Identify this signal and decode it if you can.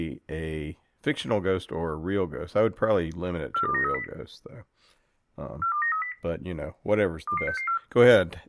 Five-tone selective call (CCIR), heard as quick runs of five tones, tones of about 100 ms, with speech in English. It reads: 42930 42930 22664